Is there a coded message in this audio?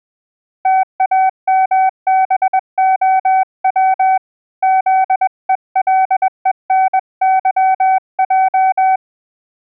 Yes: Morse code (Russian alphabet) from 0.6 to 9.0 s, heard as a keyed tone, hand-sent with a paddle, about 21 wpm, 760 Hz. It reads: ТАМБОВ ЗЕЛЕНЫЙ